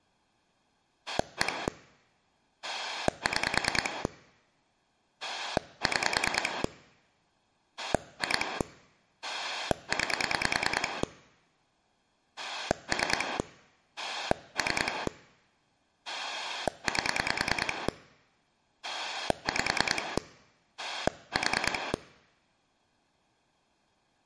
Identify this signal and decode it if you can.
Pulse dialling, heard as a rotary dial, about 10 pulses a second. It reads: 1 6 6 2 9 3 3 8 5 4